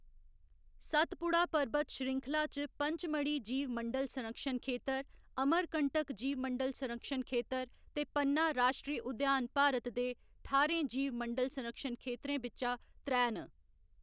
Speech in Dogri. There is no code.